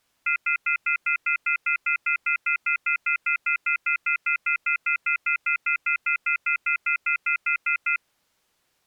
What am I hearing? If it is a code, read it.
Telephone call progress tone (North American plan), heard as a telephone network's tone, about 1400, 2050, 2450, 2600 Hz, 0.1 s on and 0.1 s off. Off-hook warning tone.